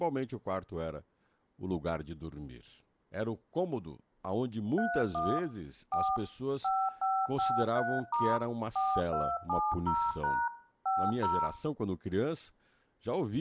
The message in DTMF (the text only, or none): 31 4 5553* 4270# 50